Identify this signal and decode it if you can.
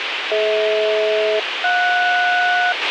Aircraft SELCAL, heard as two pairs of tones, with radio hiss and a squelch burst at the end. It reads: DH-JS